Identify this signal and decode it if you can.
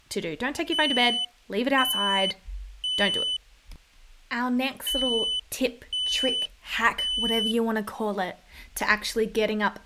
Alarm pattern, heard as an alarm's beeps, played twice, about 3000 Hz, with speech in English. Temporal three. Smoke or fire, evacuate.